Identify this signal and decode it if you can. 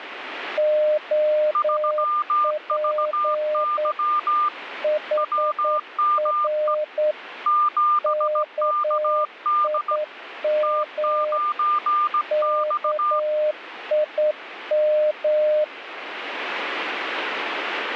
Morse code, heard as two keyed tones, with radio static. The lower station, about 9 wpm, 610 Hz: OP HR KIM KIM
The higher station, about 17 wpm, 1200 Hz: 3VY WME 7KD T9X